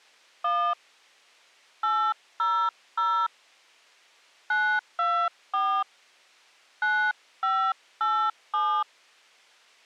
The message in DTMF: 1 800 924 9587

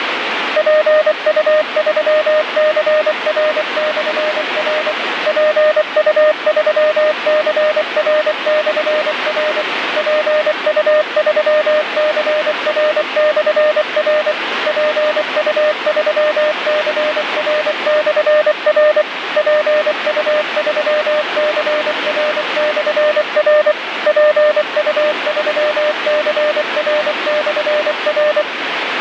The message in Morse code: PU3CR/R PU3CR/R PU3CR/R PU3CR/R PU3CR/R PU3CR/R

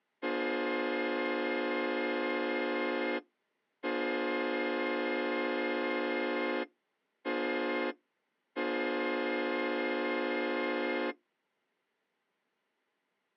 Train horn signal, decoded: 2 long, 1 short, 1 long

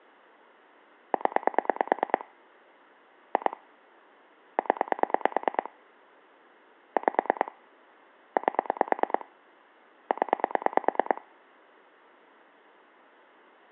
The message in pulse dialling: 0 2 0 5 8 0

